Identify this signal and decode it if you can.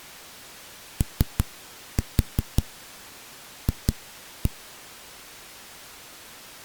Tap code, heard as knocks on a wall, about 5 knocks a second. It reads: OF